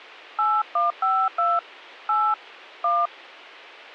DTMF, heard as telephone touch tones, dialled by hand, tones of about 210 ms. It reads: 8152 8 1